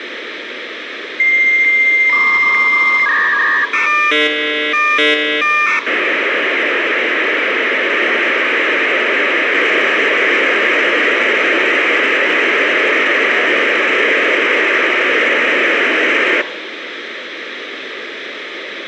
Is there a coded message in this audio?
Yes: dial-up modem handshake (V.34 or later) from 1.2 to 16.4 s, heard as a whistle, warbles, then hiss, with phone line noise.